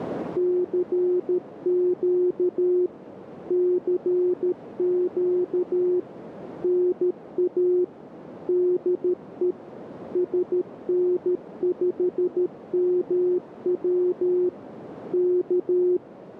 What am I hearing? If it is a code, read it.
Morse code, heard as a keyed tone, machine-sent, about 13 wpm, 360 Hz, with radio static and a narrow filter. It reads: CQ CQ NA DE SN5MW K